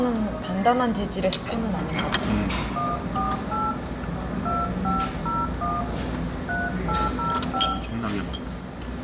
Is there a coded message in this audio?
Yes: DTMF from 2.8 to 7.7 s, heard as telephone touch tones, dialled by hand, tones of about 200 ms, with room echo and the noise of a cafe. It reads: 148 2501 3805